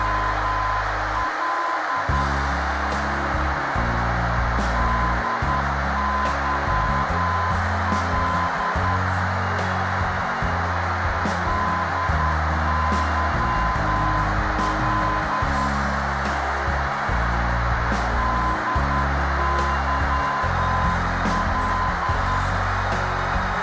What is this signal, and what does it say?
Morse code, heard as a keyed tone, machine-sent, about 10 wpm, 1020 Hz, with heavy radio static and a narrow filter. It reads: … DYL DYL DYL